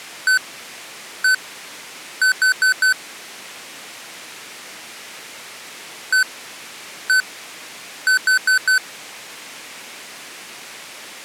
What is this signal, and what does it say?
Beep code, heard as beeps from a small speaker, played twice, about 1500 Hz. 1-1-4. In Phoenix BIOS tables: BIOS ROM checksum failure.